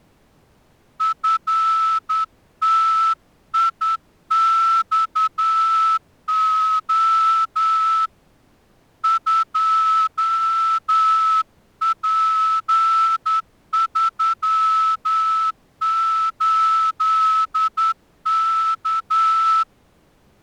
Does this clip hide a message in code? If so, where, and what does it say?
Yes: Morse code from 0.9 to 19.7 s, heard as a whistle, hand-sent with a straight key, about 10 wpm. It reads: FTIXO 2P38K